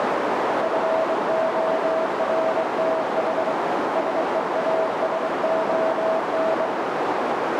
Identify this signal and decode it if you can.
Morse code, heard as a keyed tone, hand-sent with a straight key, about 23 wpm, 650 Hz, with heavy radio static and a narrow filter. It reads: FORTH SEASON